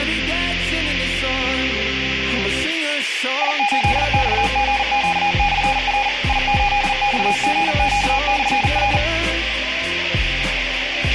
Morse code, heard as a keyed tone, machine-sent, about 40 wpm, 820 Hz, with a squelch burst at the end and room echo. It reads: I8XGQ/R I8XGQ/R